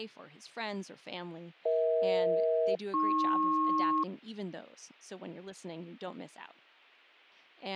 Aircraft SELCAL, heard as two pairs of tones, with speech in English. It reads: EH-AP